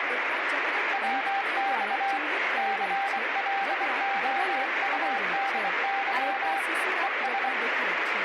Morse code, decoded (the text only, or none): WX CLOUDY ES